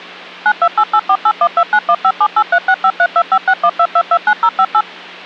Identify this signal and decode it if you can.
DTMF, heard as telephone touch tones, dialled by machine, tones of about 60 ms, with hum. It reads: 9288481291578365325612229058